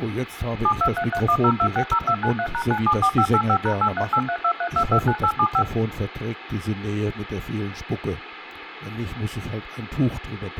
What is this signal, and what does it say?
DTMF, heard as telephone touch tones, dialled by machine, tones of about 70 ms, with phone line noise. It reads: 723310260293#974585#838323229875